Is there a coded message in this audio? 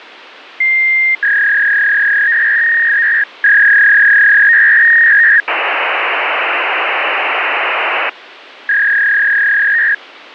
Yes: fax machine handshake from 0.6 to 9.9 s, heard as a long tone, a warble and hiss.